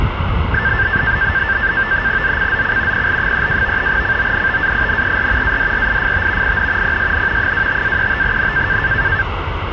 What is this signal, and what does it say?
NAVTEX (SITOR-B), 100 baud, 170 Hz shift, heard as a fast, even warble, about 1650 Hz centre, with radio static and street noise. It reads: ZCZC PL32 CONTAINER ADRIFT IN PSN 25-35N